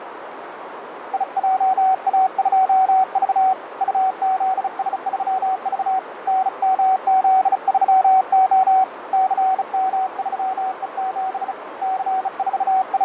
Morse code, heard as a keyed tone, hand-sent with a bug key, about 35 wpm, 760 Hz, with radio static, fading and a narrow filter. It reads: IJA2V UZS3V NMZ3O CM3E7 …